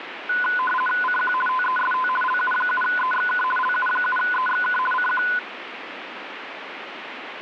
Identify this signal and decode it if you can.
RTTY (50 baud, 450 Hz shift), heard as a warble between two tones, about 1250 Hz centre, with radio static. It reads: CQ TEST LU7EXK LU7EXK CQ